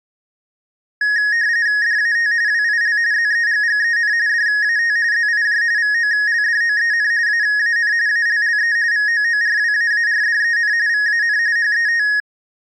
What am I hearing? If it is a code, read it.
RTTY (45.45 baud, 170 Hz shift), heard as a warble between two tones, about 1750 Hz centre. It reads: DAT WIL ZEGGEN DAT ZIJ VOLDOEN AAN ALLE VOORWAARDEN VAN HET